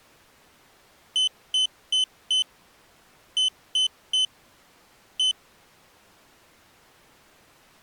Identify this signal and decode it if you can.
Beep code, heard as a piezo beeper, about 3050 Hz. 4-3-1. In Phoenix BIOS tables: memory failure above the first 64 KB.